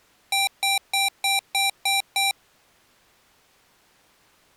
Beep code, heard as beeps from a small speaker, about 780 Hz. 7 short. In AMI BIOS tables: virtual mode exception error; in Dell tables: processor failure.